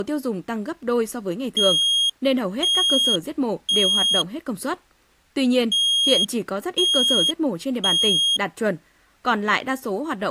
Alarm pattern, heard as an alarm's beeps, played twice, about 3250 Hz, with speech in Vietnamese. Temporal three. Smoke or fire, evacuate.